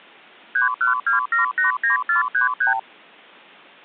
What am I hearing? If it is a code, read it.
Multi-frequency trunk signalling (R2, with the far end's replies), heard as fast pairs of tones, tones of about 130 ms. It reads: 312789433